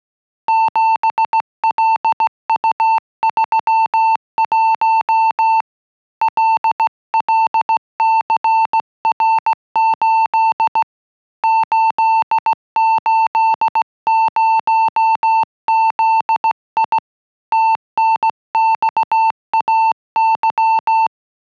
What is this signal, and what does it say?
Morse code, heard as a keyed tone, hand-sent with a straight key, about 16 wpm, 890 Hz. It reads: 7LU31 LLCR8 880ZI TNXAY